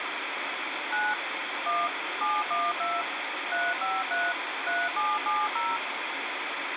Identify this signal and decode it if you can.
DTMF, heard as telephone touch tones, dialled by machine, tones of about 210 ms, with radio hiss. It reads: 9 1 712 353 3770